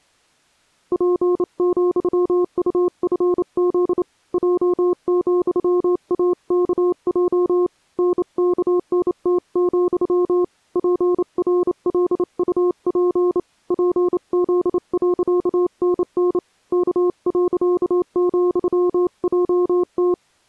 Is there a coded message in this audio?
Yes: Morse code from 0.9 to 20.2 s, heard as a keyed tone, hand-sent with a bug key, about 28 wpm, 360 Hz. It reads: P,UFZ J,AKJ NKNT, PRLUP PZ.NN K.,JT